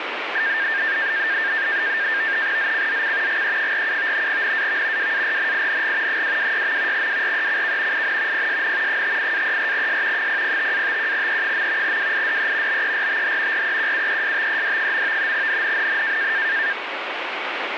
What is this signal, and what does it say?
NAVTEX (SITOR-B), 100 baud, 170 Hz shift, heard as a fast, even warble, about 1700 Hz centre, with radio static. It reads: ZCZC GE47 NAV WARNING 226. WRECK IN PSN 58-34S 005-51E. WIDE BERTH REQUESTED. NNNN